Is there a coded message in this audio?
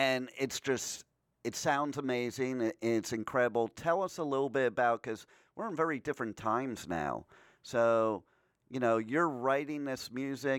No, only speech in English.